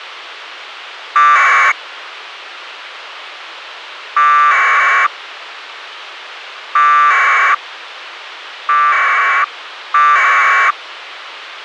Packet radio (AX.25, as in APRS), 1200 baud, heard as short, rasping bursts, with radio hiss.